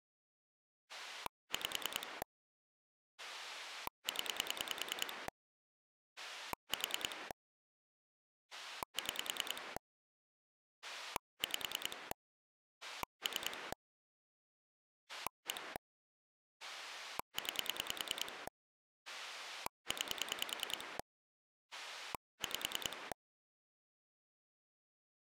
Pulse dialling, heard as a rotary dial, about 10 pulses a second. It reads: 5 0 4 6 5 3 1 9 9 5